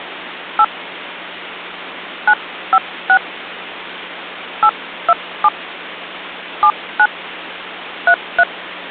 DTMF, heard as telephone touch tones, dialled by hand, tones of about 70 ms. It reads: 8 956 827 79 33